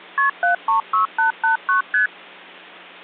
Multi-frequency trunk signalling (R1, as on North American trunks), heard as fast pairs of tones, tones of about 120 ms. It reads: KP 736889 ST